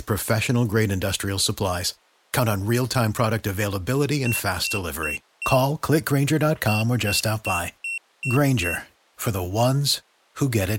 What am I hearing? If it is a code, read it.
Beep code, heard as a piezo beeper, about 2700 Hz, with speech in English. 4-6.